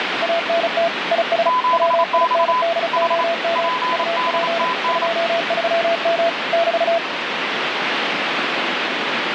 Morse code, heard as two keyed tones, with radio static. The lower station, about 35 wpm, 670 Hz: ANT IS WINDOM UP 23M <BT>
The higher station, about 28 wpm, 1010 Hz: 7X H PDTN